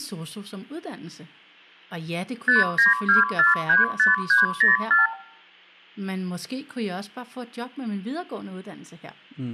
Multi-frequency trunk signalling (R2, with the far end's replies), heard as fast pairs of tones, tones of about 150 ms, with speech in Danish. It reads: 592435304